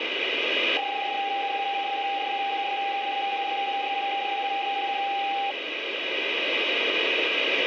PSK31 (31.25 baud), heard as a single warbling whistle, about 800 Hz, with radio static.